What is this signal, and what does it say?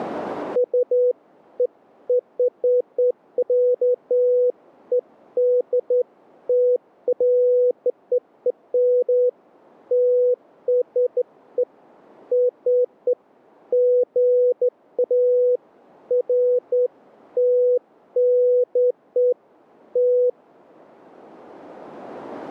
Beeps of irregular length. There is no code.